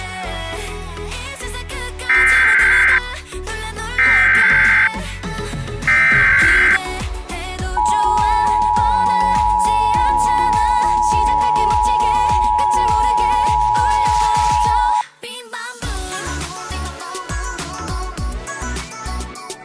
Emergency Alert System (SAME) tones (header bursts, then the 853 and 960 Hz attention tone), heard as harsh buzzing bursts, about 520.83 baud.